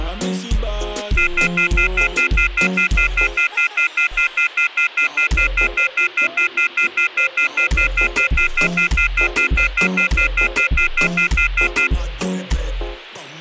Telephone call progress tone (North American plan), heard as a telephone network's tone, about 1400, 2050, 2450, 2600 Hz, 0.1 s on and 0.1 s off. Off-hook warning tone.